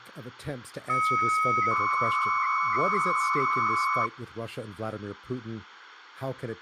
300-baud modem data (Bell 103 tones), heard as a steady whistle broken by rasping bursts, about 300 baud, 200 Hz shift, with phone line noise and speech in English.